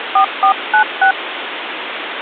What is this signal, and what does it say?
DTMF, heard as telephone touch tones, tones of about 100 ms, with phone line noise. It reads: 4496